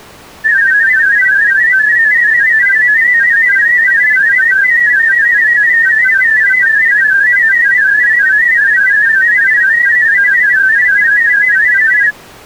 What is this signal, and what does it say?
Multi-tone FSK (Olivia or MFSK type), about 500 Hz wide, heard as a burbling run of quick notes, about 31.25 baud.